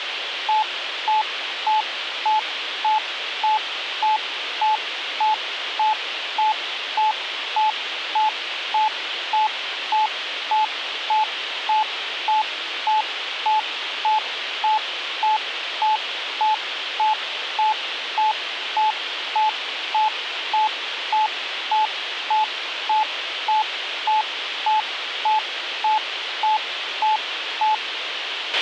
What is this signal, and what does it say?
Evenly repeated beeps, with radio hiss and a squelch burst at the end. There is no code.